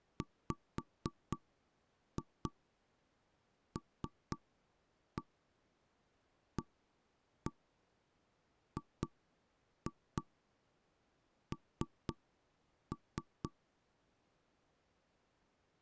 Tap code, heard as knocks on wood, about 4 knocks a second. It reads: WLAGN